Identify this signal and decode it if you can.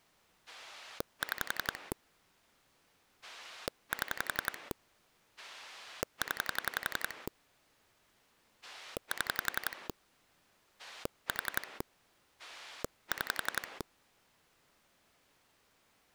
Pulse dialling, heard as a rotary dial, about 11 pulses a second. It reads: 6 7 0 7 4 6